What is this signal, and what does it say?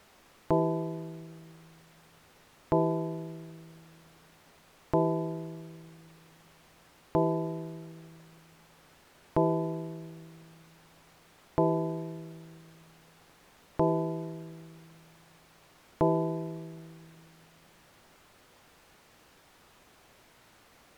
Clock strike, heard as a bell. 8. Eight o'clock.